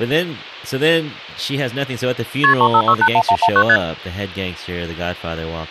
Multi-frequency trunk signalling (R1, as on North American trunks), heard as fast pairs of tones, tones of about 70 ms, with speech in English. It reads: KP 35681119 ST